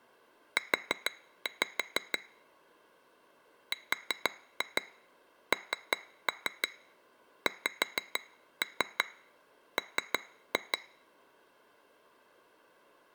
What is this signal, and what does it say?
Tap code, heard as taps on glass, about 6 knocks a second. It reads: U RNXM